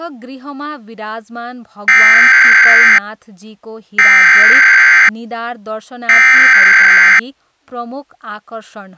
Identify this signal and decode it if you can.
Emergency Alert System (SAME) tones (header bursts), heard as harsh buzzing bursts, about 520.83 baud, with speech in Nepali.